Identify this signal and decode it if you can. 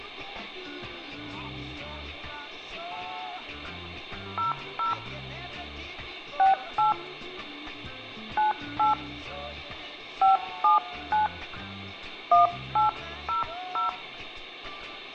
DTMF, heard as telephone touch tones, dialled by hand, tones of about 140 ms, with hum and room echo. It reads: 00 68 98 579 1800